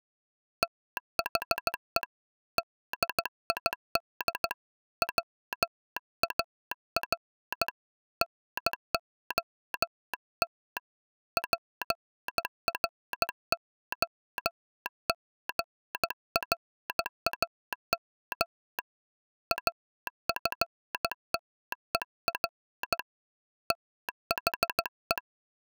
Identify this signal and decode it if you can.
Morse code, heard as a telegraph sounder, hand-sent with a bug key, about 15 wpm. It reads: THE DID WAR NOT PROGRAM AFTER THE